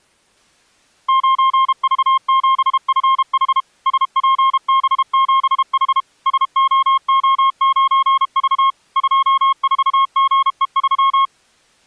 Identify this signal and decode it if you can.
Morse code, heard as a keyed tone, machine-sent, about 32 wpm, 1070 Hz. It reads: 9V7FH SPB7H SOO9V 24GE3